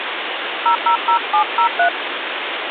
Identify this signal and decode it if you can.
DTMF, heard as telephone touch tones, dialled by hand, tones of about 100 ms, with phone line noise. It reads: 000703